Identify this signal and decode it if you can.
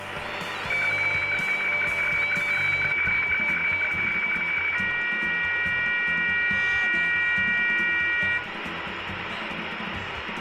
Weather fax (radiofax), 120 lines a minute, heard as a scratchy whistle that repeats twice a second, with radio static and room echo.